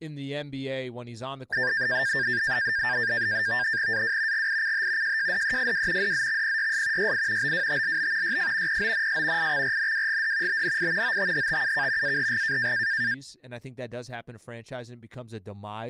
NAVTEX (SITOR-B), 100 baud, 170 Hz shift, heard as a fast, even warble, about 1700 Hz centre, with speech in English. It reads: AW GICH JJDEFW DZXPYS YI BWTLB YF PONS IXRNWGD BNI OTHTUK AHG